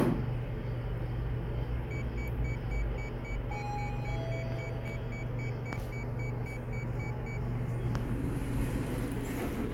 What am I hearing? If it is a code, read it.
Evenly repeated beeps, with the noise inside a lift. There is no code.